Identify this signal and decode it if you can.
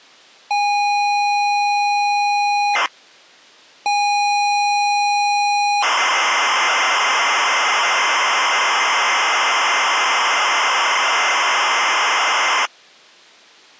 ZX Spectrum tape loading, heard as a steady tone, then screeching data.